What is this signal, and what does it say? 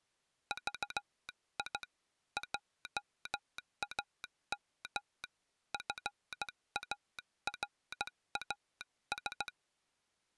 Morse code, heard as a telegraph sounder, hand-sent with a straight key, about 16 wpm. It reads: VI JAM FARAS